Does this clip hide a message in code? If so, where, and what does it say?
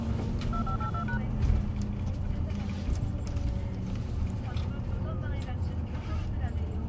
Yes: DTMF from 0.5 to 1.2 s, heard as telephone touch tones, dialled by machine, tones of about 90 ms, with the noise inside a bus. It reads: 2582#